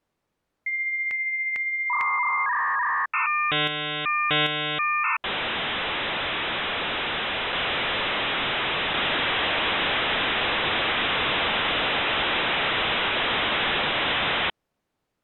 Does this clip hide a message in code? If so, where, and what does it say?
Yes: dial-up modem handshake (V.34 or later) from 0.7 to 14.5 s, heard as a whistle, warbles, then hiss.